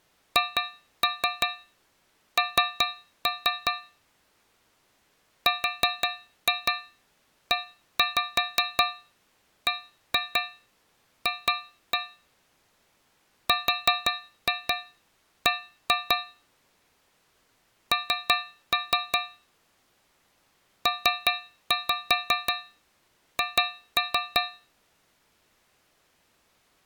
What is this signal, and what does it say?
Tap code, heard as taps on a metal pipe, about 5 knocks a second. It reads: HN REBF RB N PH